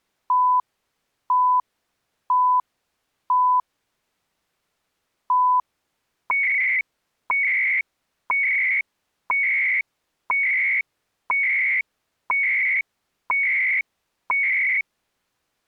Radio time signal (CHU, Canada), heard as beeps and data bursts, one a second.